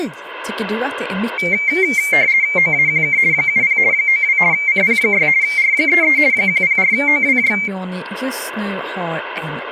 RTTY (50 baud, 170 Hz shift), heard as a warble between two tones, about 2200 Hz centre, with speech in Swedish. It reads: OAQK 70 92 CP6 R33 104OWJ